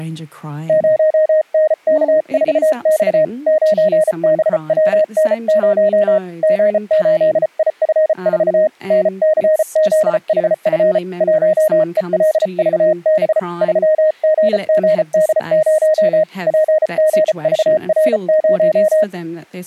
Morse code, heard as a keyed tone, hand-sent with a bug key, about 34 wpm, 620 Hz, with speech in English. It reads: 0NK4X 9BWN0 G8IF4 NCZHF 1ELVB 3GGD0 PGVR0